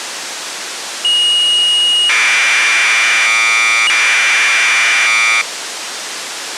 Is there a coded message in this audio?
Yes: Commodore tape loading (standard loader) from 1.0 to 5.4 s, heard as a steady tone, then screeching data, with tape hiss.